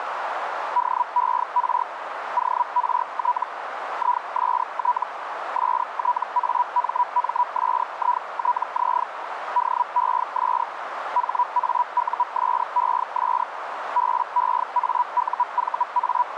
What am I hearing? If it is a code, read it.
Hellschreiber (Feld-Hell, 122.5 baud), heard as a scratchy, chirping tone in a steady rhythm, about 980 Hz, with radio static and a narrow filter. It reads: DER ORT IST STAMMSITZ DES HAUSES …